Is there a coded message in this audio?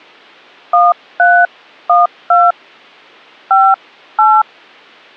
Yes: DTMF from 0.7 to 4.4 s, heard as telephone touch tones, dialled by hand, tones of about 200 ms. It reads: 1312 58